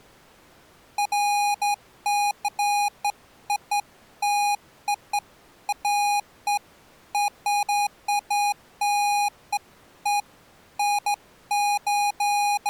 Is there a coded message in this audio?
No, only beeps of irregular length.